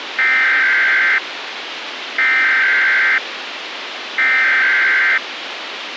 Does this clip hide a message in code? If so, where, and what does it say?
Yes: Emergency Alert System (SAME) tones (header bursts) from 0.2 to 5.2 s, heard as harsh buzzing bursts, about 520.83 baud, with radio hiss.